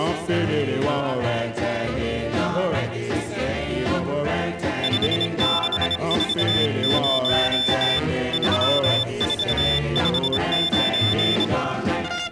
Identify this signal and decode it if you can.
Morse code, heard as a high beeper, hand-sent with a bug key, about 26 wpm, 3550 Hz. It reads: 5640 3459